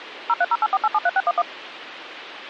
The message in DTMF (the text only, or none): 03084873611